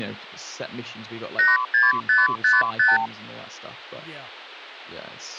Multi-frequency trunk signalling (R2, with the far end's replies), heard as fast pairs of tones, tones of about 180 ms, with speech in English. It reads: 86555